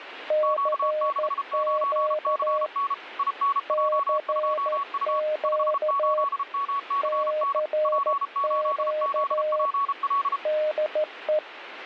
Morse code, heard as two keyed tones, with radio static. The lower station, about 14 wpm, 610 Hz: CQ CQ CQ DE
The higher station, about 33 wpm, 1120 Hz: Q69CN INJ2U 58MCN P8ZPL